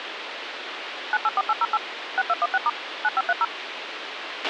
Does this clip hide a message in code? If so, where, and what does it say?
Yes: DTMF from 1.1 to 3.4 s, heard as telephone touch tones, dialled by machine, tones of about 40 ms, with radio hiss and a squelch burst at the end. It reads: 984808 6216* 9530